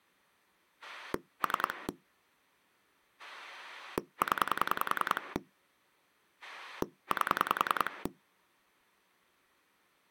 Pulse dialling, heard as a rotary dial, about 10 pulses a second. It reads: 3 0 8